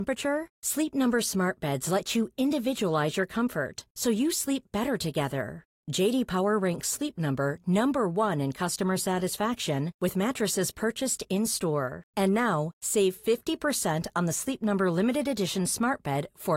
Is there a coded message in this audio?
No, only speech in Swedish.